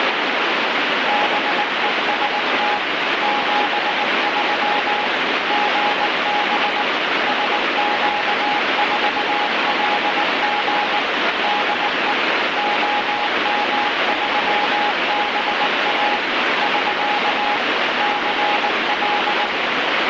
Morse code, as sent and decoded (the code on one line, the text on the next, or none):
-... . ... - / --... ...-- / --. -... / ... --.- ....- .-.. --. / -.. . / --- -- ...-- -... .- / ...-.- / -.-. .-..
BEST 73 GB SQ4LG DE OM3BA <SK> CL